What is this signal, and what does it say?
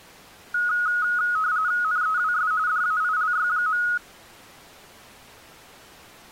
RTTY (45.45 baud, 170 Hz shift), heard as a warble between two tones, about 1360 Hz centre. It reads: NEWS DAILY.